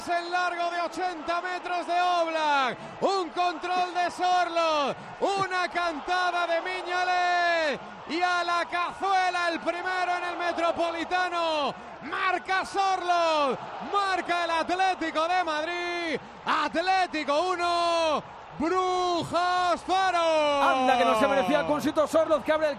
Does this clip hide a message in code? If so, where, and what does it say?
No.